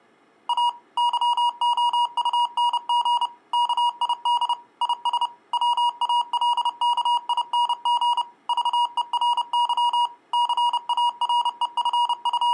Morse code, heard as electronic beeps, machine-sent, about 30 wpm, 960 Hz. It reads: A YOUNG KID IS WALKING VERY …